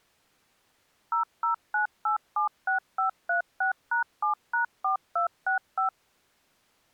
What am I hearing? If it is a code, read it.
DTMF, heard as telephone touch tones, dialled by machine, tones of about 120 ms. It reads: 009876536#7#4265